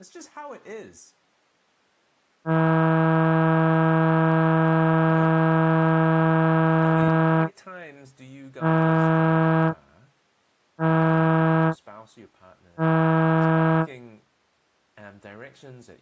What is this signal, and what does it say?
Ship horn signal, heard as a ship's horn, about 160 Hz, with speech in English. 1 long, 3 short. At sea: a vessel under tow in fog.